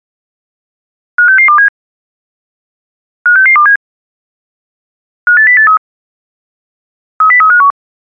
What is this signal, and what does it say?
Five-tone selective call (CCIR), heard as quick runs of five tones, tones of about 100 ms. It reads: 56627 56627 58083 30351